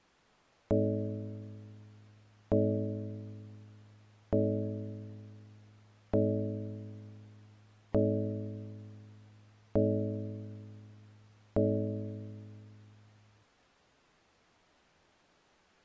Clock strike, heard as a bell. 7. Seven o'clock.